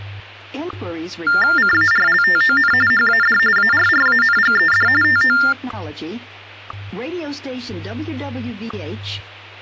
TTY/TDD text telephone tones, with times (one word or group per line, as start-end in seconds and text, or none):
1.6-2.7 CARLTON
2.9-3.4 HAD
3.6-4.9 ARRANGED
5.0-5.4 TO